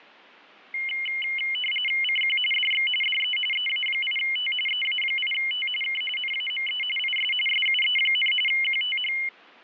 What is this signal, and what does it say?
RTTY (45.45 baud, 850 Hz shift), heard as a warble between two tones, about 2550 Hz centre. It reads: CQ DX DE EA8T EA8T K NAME IS SUE, QTH